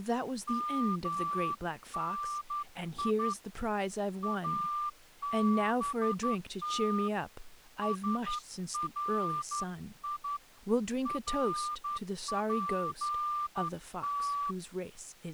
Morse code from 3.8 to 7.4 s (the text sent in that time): ABT